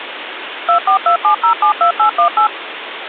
DTMF, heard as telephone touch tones, dialled by machine, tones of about 100 ms, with phone line noise. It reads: 2427072818